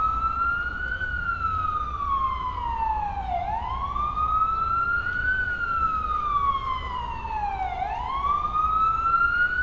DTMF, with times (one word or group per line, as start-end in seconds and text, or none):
none